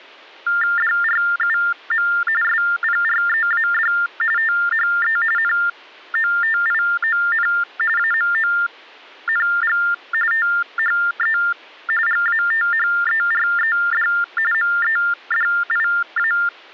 TTY/TDD text telephone tones (45.45 baud Baudot), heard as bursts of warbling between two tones, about 400 Hz shift, 1600 Hz centre. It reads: DRUM SPREAD THE NOTION AMONG THE GATHERED MEDIA